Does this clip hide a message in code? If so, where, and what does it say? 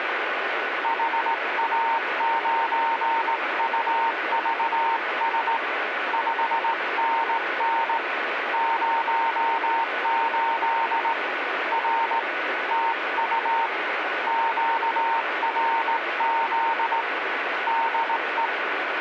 Yes: Morse code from 0.8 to 18.5 s, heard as a keyed tone, hand-sent with a straight key, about 18 wpm, 920 Hz, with radio static. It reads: HA9UVS 5NN 08 R TU QRZ DE